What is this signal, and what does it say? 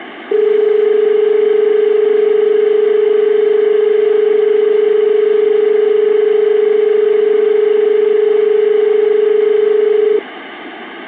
Telephone call progress tone (as in Australia), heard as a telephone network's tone, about 430 Hz, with phone line noise. Dial tone.